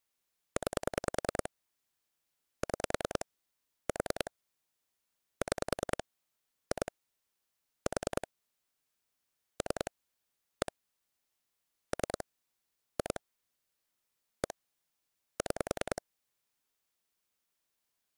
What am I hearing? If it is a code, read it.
Pulse dialling, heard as clicks on a phone line, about 10 pulses a second. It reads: 9 6 4 6 2 4 3 1 3 2 1 6